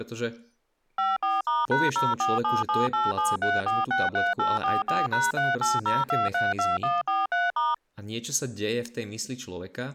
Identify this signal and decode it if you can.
DTMF, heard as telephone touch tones, dialled by machine, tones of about 180 ms, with speech in Slovak. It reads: 54*#0477873463844#380232143*